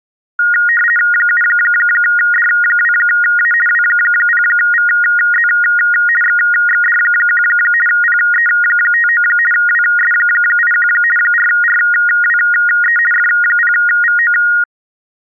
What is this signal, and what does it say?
RTTY (50 baud, 450 Hz shift), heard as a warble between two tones, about 1650 Hz centre. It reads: 7D2A W0VZ XXD1 PE59 WS81 4RWE F0VO